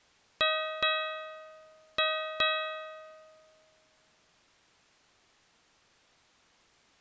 Ship's bell, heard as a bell. 4. Four half-hours of the watch have passed.